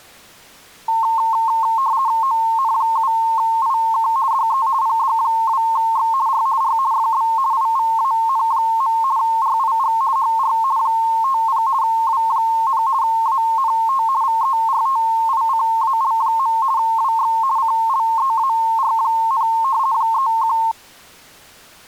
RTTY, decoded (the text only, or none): ON7IK DE PD2X R R FB IVAN. RIG HR 50 W, ANT VERTICAL. WX CLEAR, 31